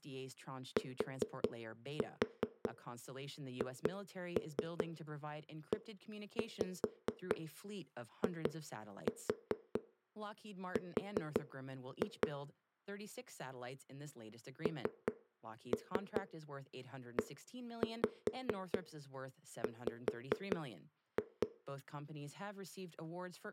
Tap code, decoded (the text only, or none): THEIR NEW